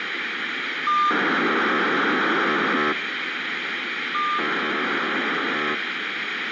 POCSAG pager data (2400 baud), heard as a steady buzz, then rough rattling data, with radio hiss.